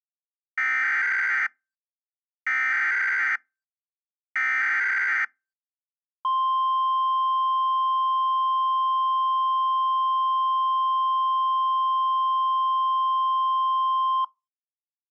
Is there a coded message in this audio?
Yes: Emergency Alert System (SAME) tones (header bursts, then the 1050 Hz attention tone) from 0.6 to 14.2 s, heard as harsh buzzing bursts, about 520.83 baud.